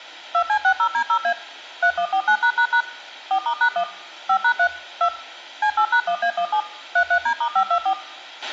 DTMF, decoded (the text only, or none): 2C60D0A 3149### 4*#1 5#3 2 C8#1A17 33D*524